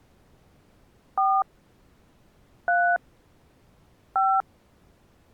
DTMF, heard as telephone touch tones, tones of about 210 ms. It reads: 4 3 5